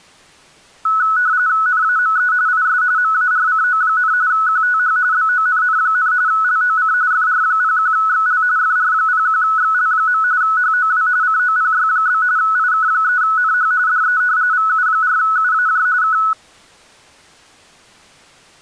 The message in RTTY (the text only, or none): NAME IS MARCO, QTH BONN, LOC FR01XL FR01XL. HOW COPY? IK3NH DE VU4UAJ K